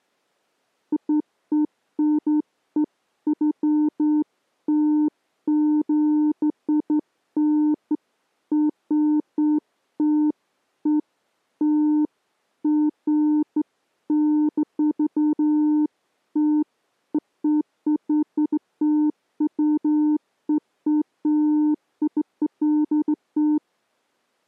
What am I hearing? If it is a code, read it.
Beeps of irregular length. There is no code.